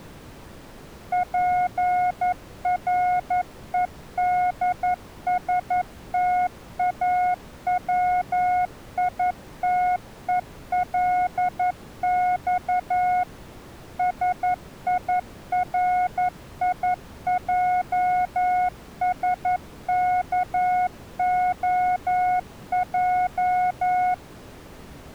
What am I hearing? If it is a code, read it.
Morse code (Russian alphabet), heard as a keyed tone, machine-sent, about 11 wpm, 720 Hz. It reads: ПРЕДСТАВИТЕЛЬ СИРИЙСКОЙ